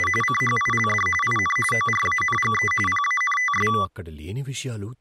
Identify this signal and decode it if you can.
RTTY (45.45 baud, 850 Hz shift), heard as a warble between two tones, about 1550 Hz centre, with speech in Telugu. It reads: … CHILD IN ORANGE PANTS